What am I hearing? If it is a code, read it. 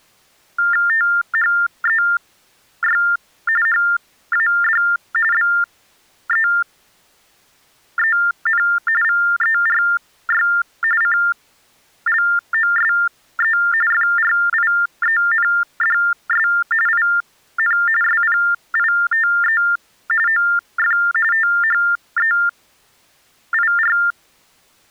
TTY/TDD text telephone tones (45.45 baud Baudot), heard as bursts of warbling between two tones, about 400 Hz shift, 1600 Hz centre. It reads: THEY HAD BEEN VERY CLOSE FRIENDS IN SPITE OF THEIR